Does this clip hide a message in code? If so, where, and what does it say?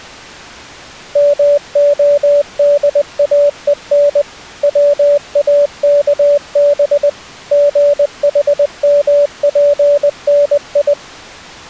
Yes: Morse code (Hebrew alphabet) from 1.1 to 11.0 s, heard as a keyed tone, machine-sent, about 20 wpm, 580 Hz. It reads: מהדאון צאכב גחמפני